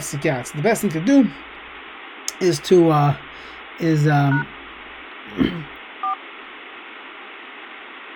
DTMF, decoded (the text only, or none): # 4